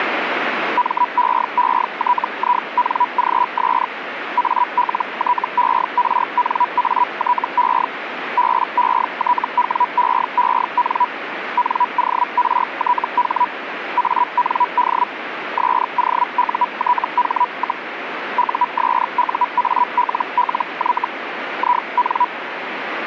Hellschreiber (Feld-Hell, 122.5 baud), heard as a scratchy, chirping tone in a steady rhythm, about 980 Hz, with radio static. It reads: MEETINGS ALTERNATE BETWEEN NORTH AND SOUTH, USUALLY IN